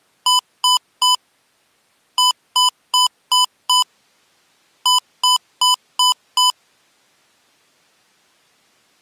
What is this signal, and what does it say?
Beep code, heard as beeps from a small speaker, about 1000 Hz. 3-5-5.